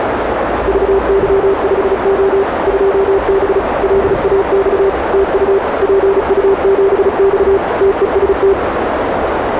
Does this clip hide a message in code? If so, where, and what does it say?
Yes: Morse code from 0.6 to 8.6 s, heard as a keyed tone, machine-sent, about 35 wpm, 390 Hz, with heavy radio static, a narrow filter and the noise inside a bus. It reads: VY5O 2B LAX TU PU7X TEST